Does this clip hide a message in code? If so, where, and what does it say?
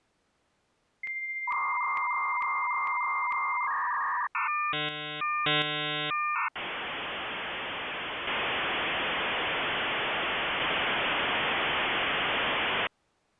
Yes: dial-up modem handshake (V.34 or later) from 1.0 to 12.9 s, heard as a whistle, warbles, then hiss.